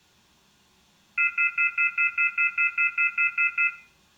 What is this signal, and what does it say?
Telephone call progress tone (North American plan), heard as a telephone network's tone, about 1400, 2050, 2450, 2600 Hz, 0.1 s on and 0.1 s off, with room echo. Off-hook warning tone.